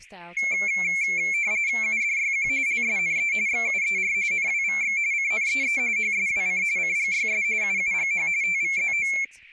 RTTY (45.45 baud, 170 Hz shift), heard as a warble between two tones, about 2250 Hz centre, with speech in English. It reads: UDYQ LSNE XUER NWVX CNEE HSWC CGYS UUGH TVZO